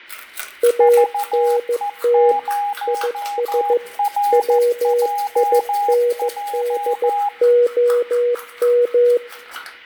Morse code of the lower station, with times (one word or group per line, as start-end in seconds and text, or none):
0.6-2.3 ANT
2.9-3.8 IS
4.3-9.2 WINDOM